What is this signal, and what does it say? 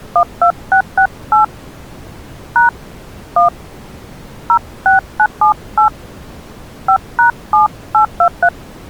DTMF, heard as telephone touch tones, dialled by hand, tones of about 100 ms. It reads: 12668 # 1 06978 5#7823